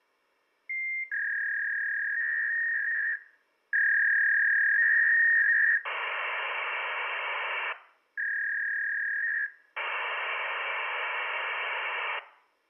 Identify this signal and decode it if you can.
Fax machine handshake, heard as a warble and hiss, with room echo.